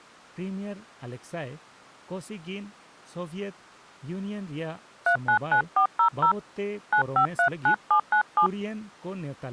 DTMF, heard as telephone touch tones, dialled by hand, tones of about 90 ms, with speech in Santali. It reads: 399400 9539797